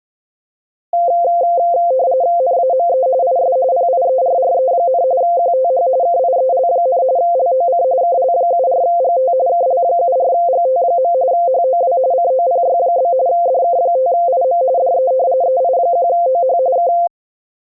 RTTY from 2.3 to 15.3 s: NAME IS PIERRE, QTH KIEL, LOC KL74GT KL74GT. HOW COPY? DK5IM DE

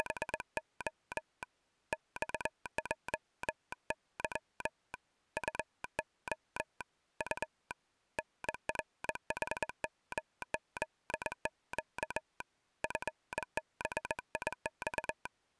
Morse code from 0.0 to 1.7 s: …

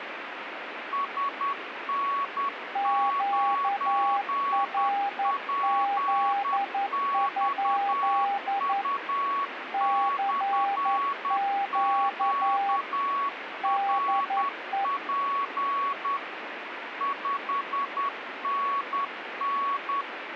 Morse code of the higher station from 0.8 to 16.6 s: SN9PXU/QRP

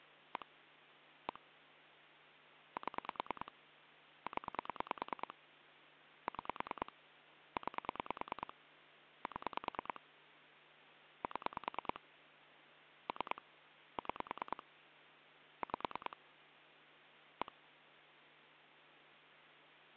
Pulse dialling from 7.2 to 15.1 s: 9 7 7 3 6

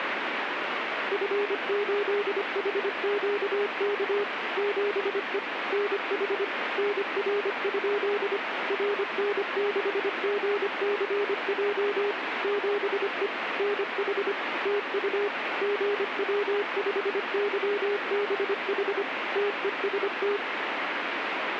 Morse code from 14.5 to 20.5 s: TU GW5YBH TEST

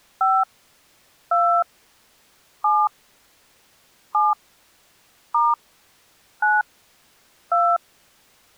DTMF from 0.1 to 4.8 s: 5 2 7 7

